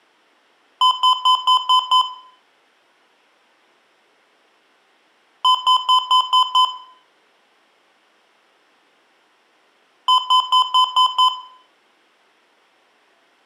Beep code, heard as beeps from a small speaker, played three times, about 1020 Hz, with room echo. 6 short. In AMI BIOS tables: keyboard controller gate A20 failure; in Dell tables: video card failure.